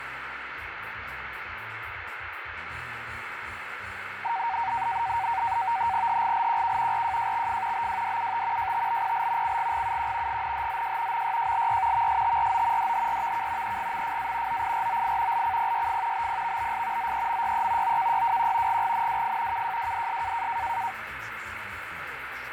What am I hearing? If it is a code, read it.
NAVTEX (SITOR-B), 100 baud, 170 Hz shift, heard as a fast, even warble, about 850 Hz centre, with radio static and fading. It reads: HGLQK RJJXF BWDUT JTBPL CGGUQ GNHZJ MYJLY VSTRO DHRVK EGMFA OIROI LCPYF BPVBS ZEMYE OKYWQ GGNWF KJWDS